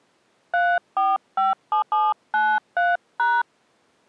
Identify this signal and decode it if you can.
DTMF, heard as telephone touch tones, dialled by hand, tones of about 190 ms. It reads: 3457793#